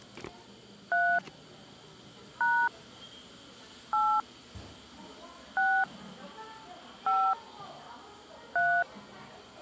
DTMF, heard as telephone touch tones, dialled by hand, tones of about 270 ms, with the noise of a cafe. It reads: 3 # 8 6 5 3